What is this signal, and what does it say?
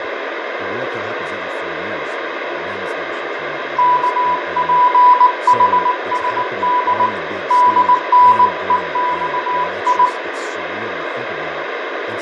Morse code, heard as a keyed tone, hand-sent with a bug key, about 19 wpm, 990 Hz, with radio static, fading, room echo and speech in English. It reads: KPHSD DNEXI